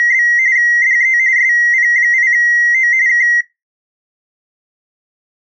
RTTY (45.45 baud, 170 Hz shift), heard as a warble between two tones, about 2000 Hz centre. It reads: … DE SP8O K